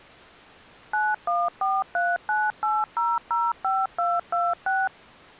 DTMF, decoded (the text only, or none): 914398005226